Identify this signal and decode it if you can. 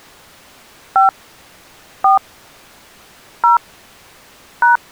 DTMF, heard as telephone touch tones, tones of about 130 ms. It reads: 5 4 0 #